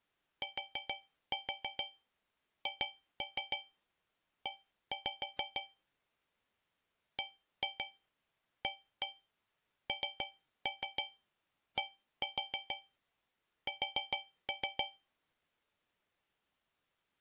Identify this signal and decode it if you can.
Tap code, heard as taps on a metal pipe, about 6 knocks a second. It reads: THE BANDS